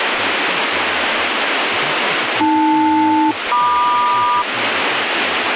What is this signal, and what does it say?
Aircraft SELCAL, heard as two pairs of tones, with radio static and speech in English. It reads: AL-MQ